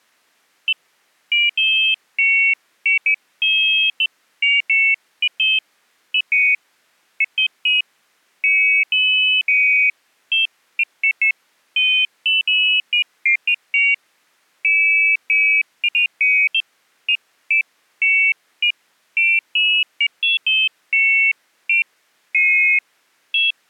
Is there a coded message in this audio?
No, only pairs of high tones at irregular times.